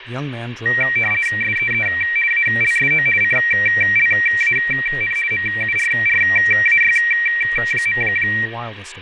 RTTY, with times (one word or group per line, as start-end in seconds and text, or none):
1.4-1.9 SEE
2.3-3.1 ALSO
3.2-5.2 CLAN
5.3-8.0 MURRAY.